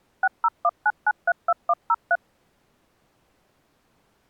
DTMF, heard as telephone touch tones, dialled by machine, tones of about 50 ms. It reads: 6019932103